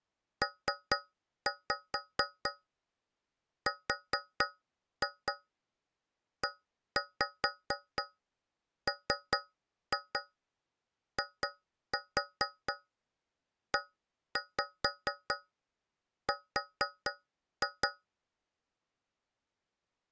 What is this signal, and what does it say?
Tap code, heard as taps on a metal pipe, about 4 knocks a second. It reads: PREMIER